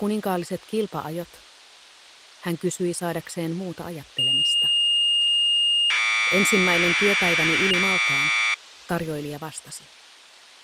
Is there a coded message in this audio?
Yes: Commodore tape loading (standard loader) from 4.2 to 8.5 s, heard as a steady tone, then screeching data.